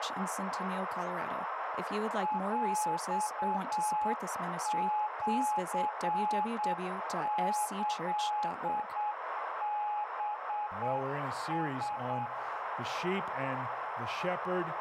Morse code (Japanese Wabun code), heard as a keyed tone, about 8 wpm, 840 Hz, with radio static and a narrow filter. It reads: ヰシキハラ